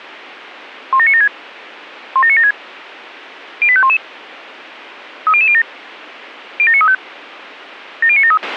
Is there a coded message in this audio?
Yes: five-tone selective call (ZVEI) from 0.9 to 8.4 s, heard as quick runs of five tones, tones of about 70 ms, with a squelch burst at the end. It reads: 17976 17976 08511 30007 07935 70973